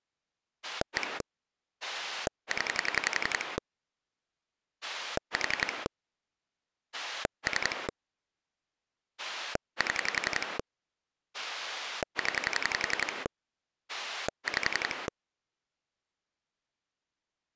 Pulse dialling, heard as a rotary dial, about 11 pulses a second. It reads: 1 0 4 3 7 0 5